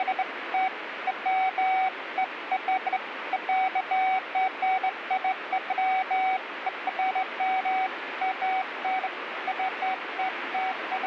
Beeps of irregular length, with radio static. There is no code.